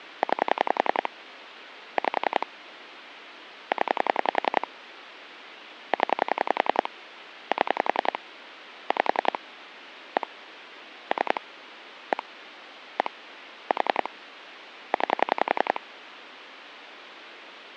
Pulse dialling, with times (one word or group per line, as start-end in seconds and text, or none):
0.2-1.1 9
2.0-2.5 5
3.7-4.7 0
5.9-6.9 0
7.5-8.2 7
8.9-9.4 5
10.2-10.3 1
11.1-11.4 3
12.1-12.2 1
13.0-13.1 1
13.7-14.1 4
14.9-15.8 9